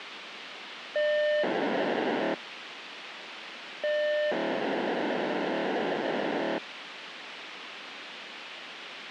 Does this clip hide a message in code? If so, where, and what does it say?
Yes: POCSAG pager data (1200 baud) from 1.0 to 6.6 s, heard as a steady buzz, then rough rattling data, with radio hiss.